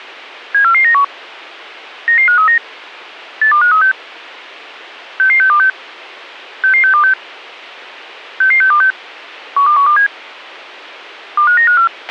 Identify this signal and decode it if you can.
Five-tone selective call (CCIR), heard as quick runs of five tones, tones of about 100 ms, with a squelch burst at the end. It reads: 74491 99539 82536 66626 66626 66626 12127 25954